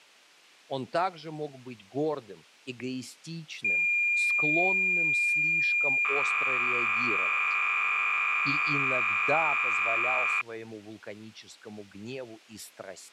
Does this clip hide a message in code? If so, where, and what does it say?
Yes: cassette data (Kansas City type), 300 baud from 3.6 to 10.4 s, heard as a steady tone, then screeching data.